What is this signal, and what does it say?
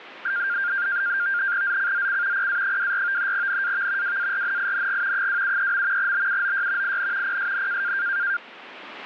NAVTEX (SITOR-B), 100 baud, 170 Hz shift, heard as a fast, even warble, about 1500 Hz centre. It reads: ZCZC PA24 NAV WARNING 273. BUOY IN PSN